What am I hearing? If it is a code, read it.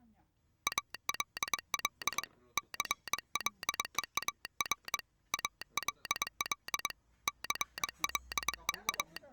Morse code, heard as a telegraph sounder, hand-sent with a paddle, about 22 wpm, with the noise of a restaurant. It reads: ALL CLEAR ALL …